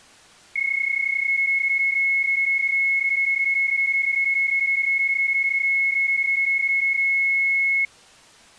PSK31 (31.25 baud), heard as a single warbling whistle, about 2200 Hz.